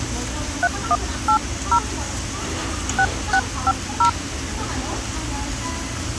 DTMF, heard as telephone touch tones, dialled by hand, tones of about 80 ms, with phone line noise and the noise of a crowd indoors. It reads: 3180 6650